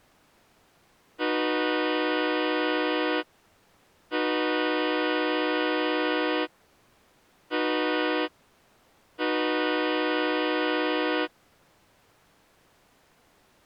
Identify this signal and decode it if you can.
Train horn signal, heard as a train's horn. 2 long, 1 short, 1 long. On North American railways: approaching a public crossing.